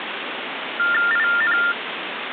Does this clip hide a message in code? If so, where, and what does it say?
Yes: TTY/TDD text telephone tones (45.45 baud Baudot) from 0.8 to 1.7 s, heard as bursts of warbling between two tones, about 400 Hz shift, 1600 Hz centre, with phone line noise. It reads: IN